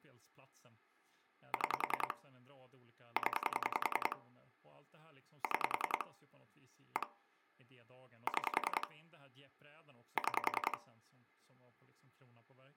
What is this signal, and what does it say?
Pulse dialling, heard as clicks on a phone line, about 10 pulses a second, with speech in Swedish. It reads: 6 0 6 1 6 6